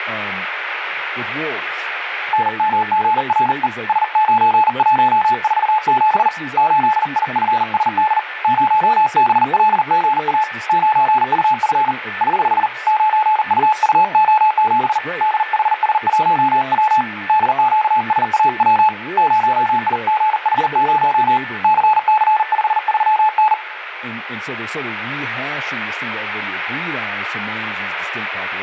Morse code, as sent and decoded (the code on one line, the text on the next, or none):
-. -- --. .-. . / ... ----. .---- ....- --... / ---.. .. ..-. ... -.. / ----- -... .-.. --. .- / ----. ..- ..-. / ........ / ----. ..- ..- --- --... / -.. .... ... .---- .-- / -.. --.- ... .- .-- / ----- .. --. .... ----- / -.-. -.-. ..... ...-- -.
NMGRE S9147 8IFSD 0BLGA 9UF <HH> 9UUO7 DHS1W DQSAW 0IGH0 CC53N